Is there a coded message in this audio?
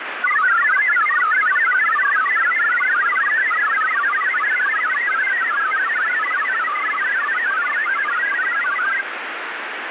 Yes: multi-tone FSK (Olivia or MFSK type), about 1000 Hz wide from 0.2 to 9.0 s, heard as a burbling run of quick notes, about 62.5 baud, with radio static.